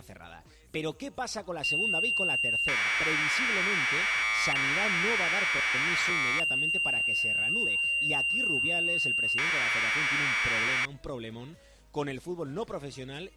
Commodore tape loading (standard loader), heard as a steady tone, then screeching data.